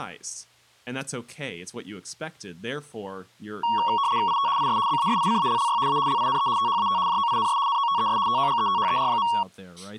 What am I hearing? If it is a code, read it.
RTTY (75 baud, 170 Hz shift), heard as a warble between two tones, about 1020 Hz centre, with speech in English. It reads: IT IS BASICALLY A LINE THAT JOINS NOTES TOGETHER.